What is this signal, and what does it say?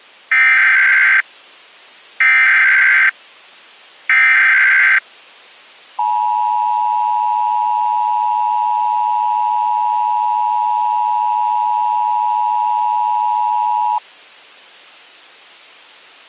Emergency Alert System (SAME) tones (header bursts, then the 853 and 960 Hz attention tone), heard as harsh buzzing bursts, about 520.83 baud.